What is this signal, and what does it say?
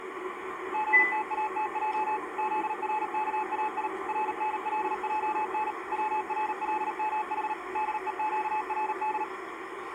Morse code (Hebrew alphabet), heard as a keyed tone, machine-sent, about 38 wpm, 860 Hz, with the noise inside a car. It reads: גתאתע זרכאי רנלען צרלמח דוקרד